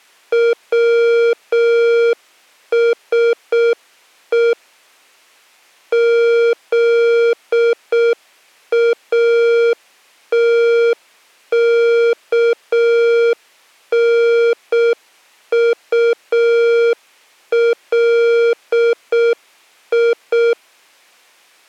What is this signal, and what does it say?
Morse code (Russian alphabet), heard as electronic beeps, machine-sent, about 6 wpm, 470 Hz. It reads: ВСЕ ЗАТКНУЛИ